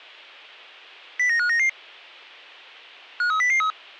Five-tone selective call (CCIR), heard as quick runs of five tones, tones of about 100 ms. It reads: 09599 53003